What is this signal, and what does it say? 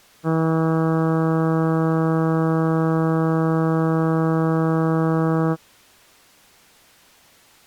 Ship horn signal, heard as a ship's horn, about 160 Hz. 1 long. At sea: a vessel nearing a blind bend, or under power and making way in fog.